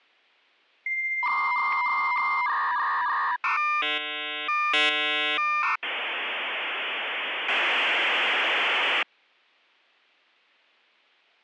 Dial-up modem handshake (V.34 or later), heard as a whistle, warbles, then hiss.